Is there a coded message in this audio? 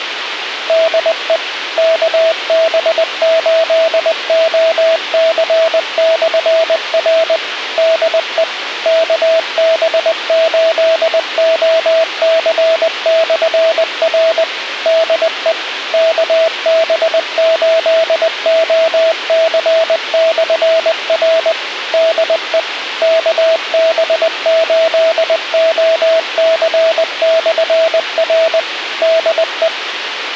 Yes: Morse code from 0.6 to 29.7 s, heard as a keyed tone, machine-sent, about 20 wpm, 650 Hz, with radio hiss and a squelch burst at the end. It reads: DE KB8OC/R DE KB8OC/R DE KB8OC/R DE KB8OC/R DE